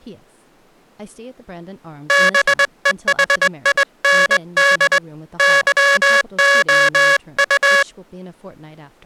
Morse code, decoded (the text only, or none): BEHIND YOU